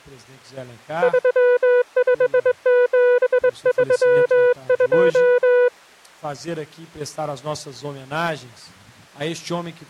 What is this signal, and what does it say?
Morse code, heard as a keyed tone, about 22 wpm, 490 Hz. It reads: 35732